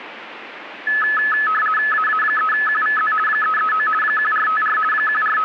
RTTY (50 baud, 450 Hz shift), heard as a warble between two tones, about 1500 Hz centre, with radio static. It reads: AA3QVZ 339 1454 …